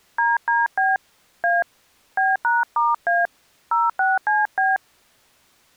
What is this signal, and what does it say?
DTMF, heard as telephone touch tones, dialled by hand, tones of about 180 ms. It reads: DDB A B#*A 06CB